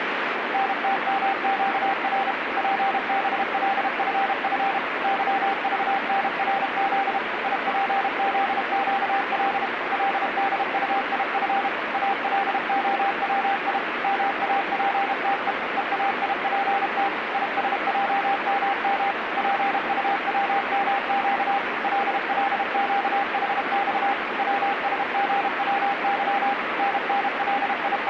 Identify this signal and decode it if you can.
Morse code, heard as a keyed tone, machine-sent, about 32 wpm, 790 Hz, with radio static. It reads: NTMQR PBLFF YVNRZ IPZQL LDUIF ALOWI MAPTE EAIPT ISJMM PUWMQ LLQHX WSGWY …